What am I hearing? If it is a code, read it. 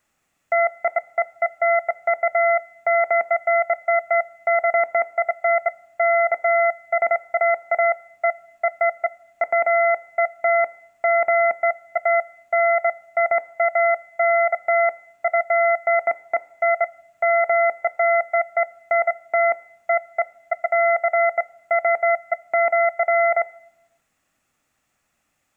Beeps of irregular length, with room echo. There is no code.